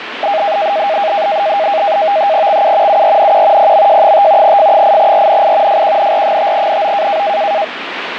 NAVTEX (SITOR-B), 100 baud, 170 Hz shift, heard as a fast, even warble, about 720 Hz centre, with radio static. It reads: XU URNQ PMJ5 F8RNI FQNR5NO